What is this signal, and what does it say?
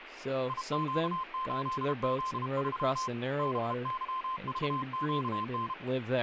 Morse code, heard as a keyed tone, hand-sent with a paddle, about 32 wpm, 1040 Hz, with radio static and speech in English. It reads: IQ8Z3 BYVQN